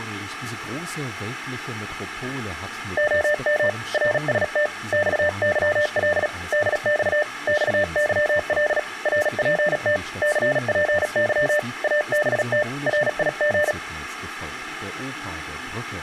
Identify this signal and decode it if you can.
Morse code, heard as a keyed tone, hand-sent with a paddle, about 37 wpm, 600 Hz, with room echo. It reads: OM RST XYL DX XYL RPT CPY ABT RIG